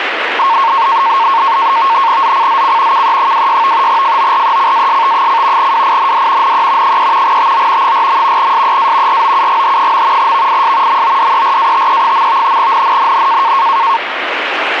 NAVTEX (SITOR-B), 100 baud, 170 Hz shift, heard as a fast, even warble, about 1000 Hz centre, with radio static. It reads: ZCZC KE26 FORECAST: WIND NE 3 TO 4. SEA ROUGH. VIS MODERATE. NNNN